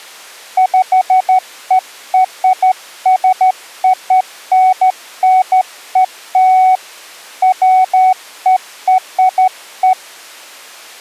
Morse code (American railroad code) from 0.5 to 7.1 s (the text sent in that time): PERSONNEL